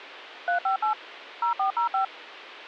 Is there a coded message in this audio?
Yes: DTMF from 0.5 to 2.0 s, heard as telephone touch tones, dialled by machine, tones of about 110 ms. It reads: 358 0405